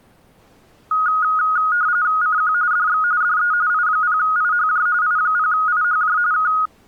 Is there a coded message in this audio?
Yes: RTTY (45.45 baud, 170 Hz shift) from 0.9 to 6.7 s, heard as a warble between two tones, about 1350 Hz centre. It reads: CQ DX DE I0IHJ I0IHJ K